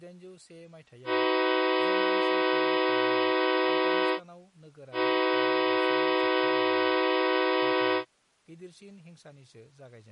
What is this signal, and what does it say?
Train horn signal, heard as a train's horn, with speech in Bodo. 2 long. On North American railways: brakes released, proceed.